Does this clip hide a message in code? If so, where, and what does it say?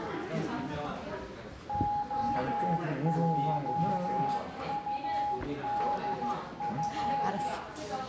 Yes: Morse code (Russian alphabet) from 1.6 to 7.5 s, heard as a keyed tone, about 13 wpm, 830 Hz, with room echo and the noise of a crowd indoors. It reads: ОЙУДФ